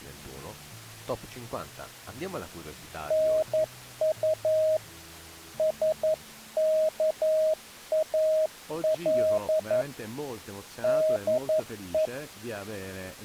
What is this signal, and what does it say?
Morse code, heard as a keyed tone, hand-sent with a paddle, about 11 wpm, 630 Hz. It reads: NU SKAL DE